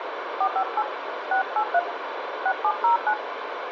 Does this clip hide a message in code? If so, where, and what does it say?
Yes: DTMF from 0.4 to 3.1 s, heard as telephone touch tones, dialled by hand, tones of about 90 ms, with phone line noise. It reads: 458 683 6709